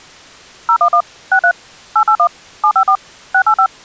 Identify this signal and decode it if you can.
DTMF, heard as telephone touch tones, dialled by machine, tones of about 80 ms. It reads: 011 63 881 754 685